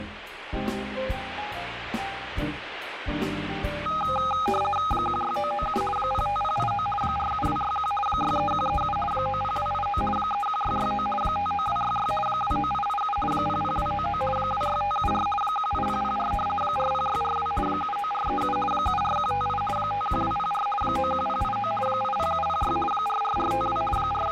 RTTY (50 baud, 450 Hz shift), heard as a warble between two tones, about 1040 Hz centre, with radio static. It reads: 16997 05089 47261 63137 90289 31669 59266 29887 00299 26574 18004 40642 79437 74158 51204 91089 80706 44452 …